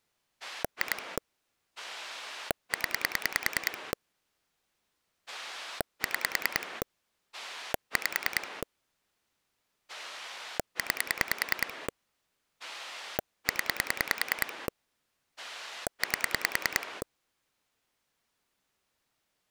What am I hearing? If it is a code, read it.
Pulse dialling, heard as a rotary dial, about 10 pulses a second. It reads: 2 0 6 5 9 0 8